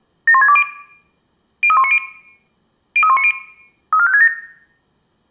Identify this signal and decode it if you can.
Five-tone selective call (ZVEI), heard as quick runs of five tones, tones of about 70 ms, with room echo. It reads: 71620 03190 03190 34567